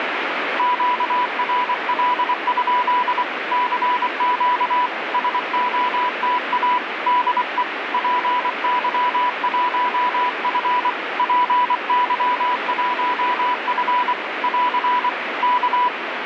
Morse code, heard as a keyed tone, hand-sent with a paddle, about 24 wpm, 990 Hz, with radio static. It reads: QRL? CQ SOTA DE PY1F PY1F <AR> K